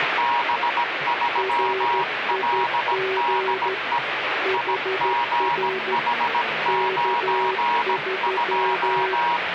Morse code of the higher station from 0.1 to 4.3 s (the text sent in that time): B3LDE